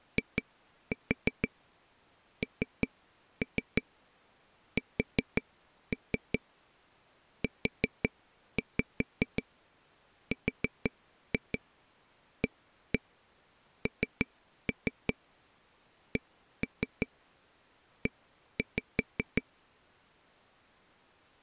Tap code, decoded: INSURANCE

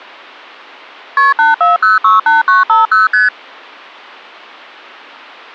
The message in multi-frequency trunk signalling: KP 84068950 ST

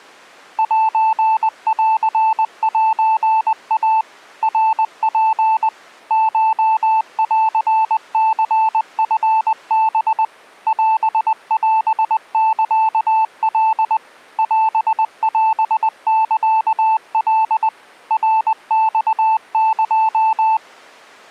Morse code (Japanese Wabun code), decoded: センセイ ナツ コンニチハ オオサカ オオサカ ナマエ

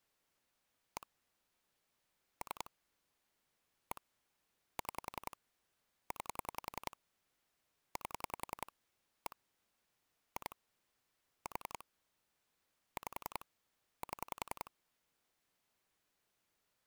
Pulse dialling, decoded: 1 3 1 6 9 8 1 2 4 5 7

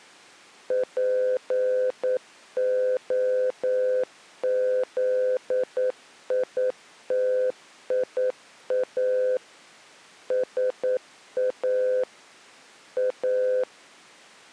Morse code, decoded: POZITIA SA A

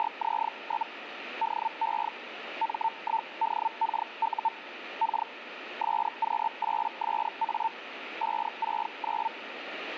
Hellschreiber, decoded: … DE M1DKU K SQ8SA 569

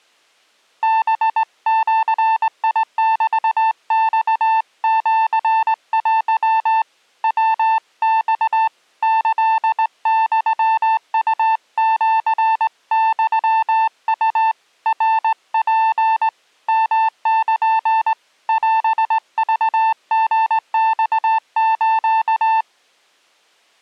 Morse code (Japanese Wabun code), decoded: ハジメマシテ ヤマ キユウシユウ ナツ ヨル オクリマス

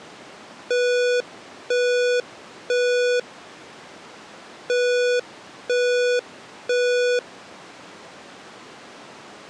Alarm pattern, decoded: temporal three

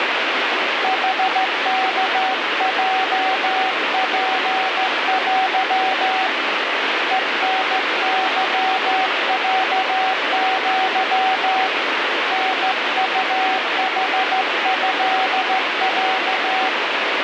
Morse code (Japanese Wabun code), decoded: ヌワヲツテ ヘタケロア タウヌトロ

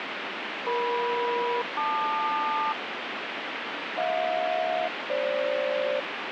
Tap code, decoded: none

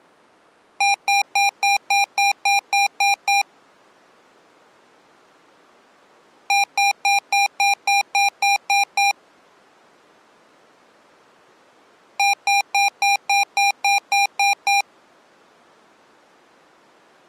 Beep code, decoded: 10 short

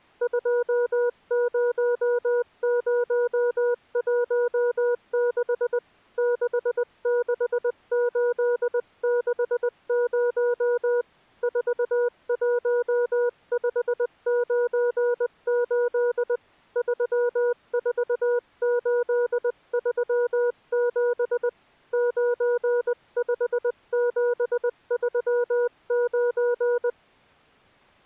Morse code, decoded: 20016 66860 41598 34837 95739

